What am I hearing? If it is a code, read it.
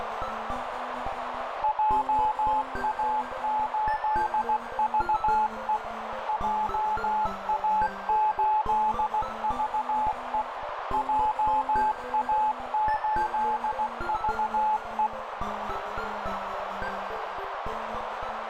Morse code, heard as a keyed tone, machine-sent, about 16 wpm, 860 Hz, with heavy radio static and a narrow filter. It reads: JA8VE JA8VE JA8VE